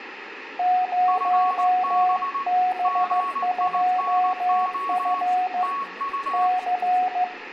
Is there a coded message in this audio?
Yes: Morse code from 0.5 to 7.3 s, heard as two keyed tones, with radio static, room echo and speech in Gujarati. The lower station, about 15 wpm, 730 Hz: 0B2F C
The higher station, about 19 wpm, 1110 Hz: FB GINO TU